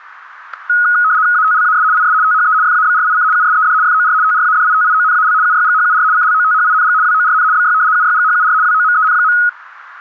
RTTY (75 baud, 170 Hz shift), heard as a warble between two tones, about 1360 Hz centre, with static crashes. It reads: ATLAS IS THE FABRIC USED FOR TRADITIONAL UYGHUR CLOTHING WORN BY UYGHUR WOMEN.